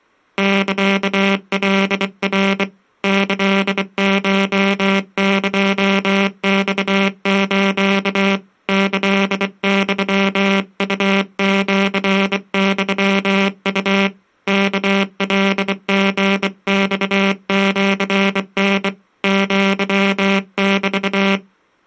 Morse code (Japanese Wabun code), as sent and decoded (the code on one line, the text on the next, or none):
-.-.- .-.. .-. / -.-.. ---- -.--- -..- ---.- / -.-.. -..-- ..- --.-. -..-- ..- / -.- .-.. --. -..- --.-. -. / --.-- -...-
サカナ キコエマス キユウシユウ ワカリマシタ アメ